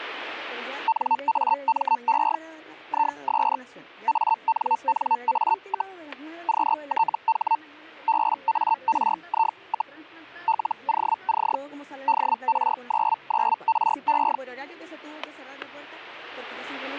Hellschreiber (Feld-Hell, 122.5 baud), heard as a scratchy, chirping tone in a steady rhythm, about 900 Hz, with static crashes. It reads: NAME IS ANNA, QTH BARI, LOC DR99RE